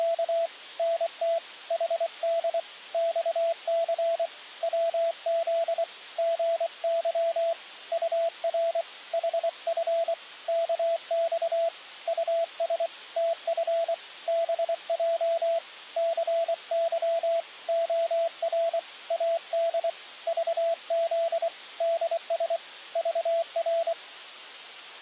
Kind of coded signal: Morse code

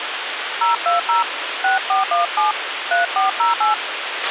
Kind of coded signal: DTMF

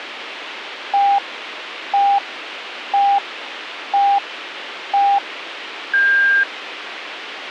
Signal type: radio time signal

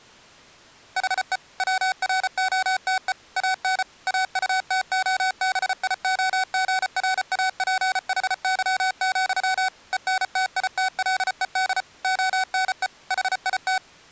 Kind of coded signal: Morse code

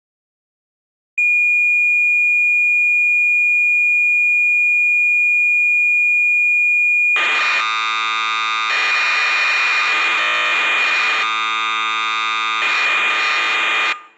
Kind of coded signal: cassette data (Kansas City type)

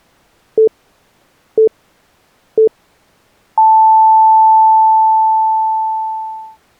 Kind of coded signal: radio time signal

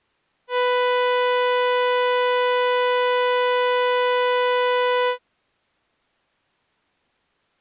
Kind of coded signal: ship horn signal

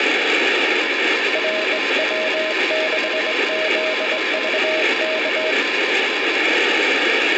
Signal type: Morse code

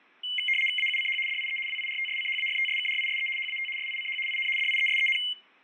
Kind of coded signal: RTTY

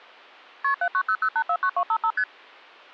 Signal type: multi-frequency trunk signalling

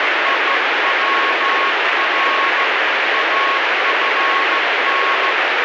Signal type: Morse code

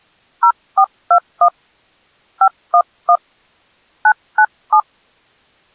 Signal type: DTMF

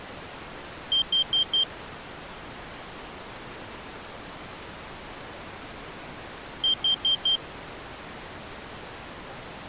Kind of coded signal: alarm pattern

